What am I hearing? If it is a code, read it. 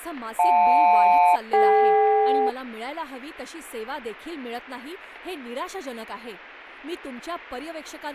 Aircraft SELCAL, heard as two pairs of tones, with radio static and speech in Marathi. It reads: JL-DK